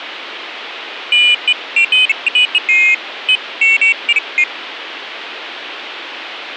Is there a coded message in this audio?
No, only pairs of high tones at irregular times, with phone line noise.